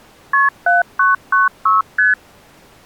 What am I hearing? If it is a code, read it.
Multi-frequency trunk signalling (R1, as on North American trunks), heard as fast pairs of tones, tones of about 160 ms. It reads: KP 7996 ST